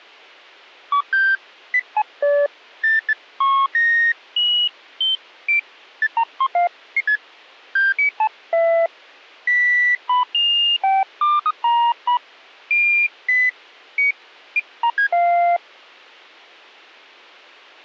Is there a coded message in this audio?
No, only electronic bleeps of random pitch and length, with a squelch burst at the end.